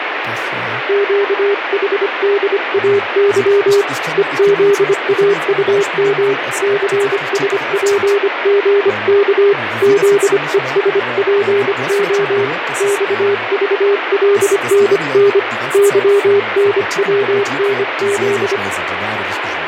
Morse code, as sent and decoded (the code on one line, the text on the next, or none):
--.- .... -.. .- -.-- / . --.. .- ..- -- / -.-. ... .--. --. -.- / --.. . ... .--. --- / -..- ...- .-.. -. -. / -.-- -. .-- -. --..
QHDAY EZAUM CSPGK ZESPO XVLNN YNWNZ